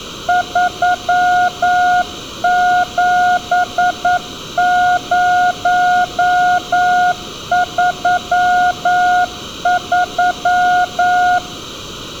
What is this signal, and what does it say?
Morse code, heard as a keyed tone, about 9 wpm, 720 Hz, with room echo. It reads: 37033